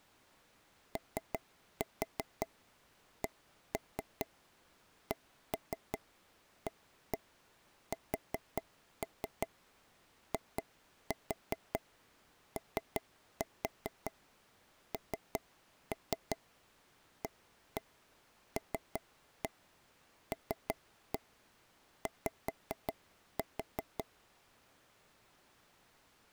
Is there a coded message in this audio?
Yes: tap code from 1.0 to 24.0 s, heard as taps on a table, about 5 knocks a second. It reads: OCCASIONALLY